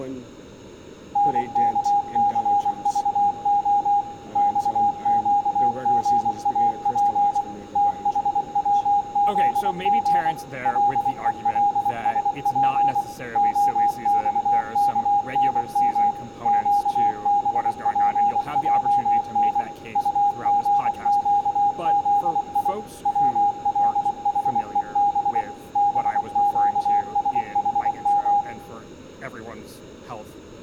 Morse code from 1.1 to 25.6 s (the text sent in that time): NKCVO XQGAP THWZG LELSP OXKNM QBPJN UGQZI WLHEB